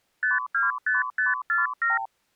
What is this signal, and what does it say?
Multi-frequency trunk signalling (R2, with the far end's replies), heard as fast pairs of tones, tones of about 160 ms. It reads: 525547